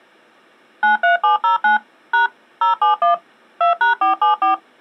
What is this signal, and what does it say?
DTMF, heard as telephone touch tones, dialled by machine, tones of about 130 ms. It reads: 93709 # 071 2#474